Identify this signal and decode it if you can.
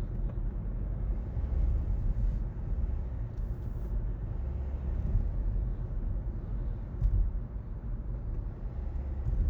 The noise inside a car. There is no code.